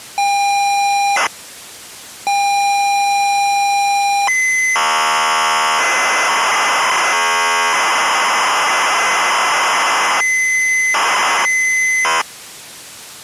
ZX Spectrum tape loading, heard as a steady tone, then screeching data.